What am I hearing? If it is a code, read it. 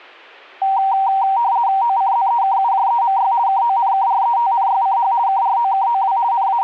RTTY (50 baud, 170 Hz shift), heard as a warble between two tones, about 860 Hz centre. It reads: OCZEKUJEMY KONKRETNYCH KROKOW …